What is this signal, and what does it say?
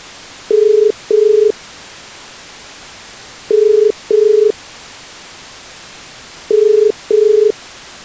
Telephone call progress tone (as in the UK, Ireland, Australia and similar networks), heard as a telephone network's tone, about 430 Hz. Ringback tone.